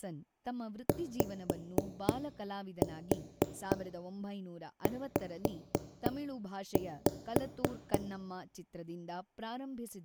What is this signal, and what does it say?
Tap code, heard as knocks on wood, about 3 knocks a second, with speech in Kannada. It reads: YZ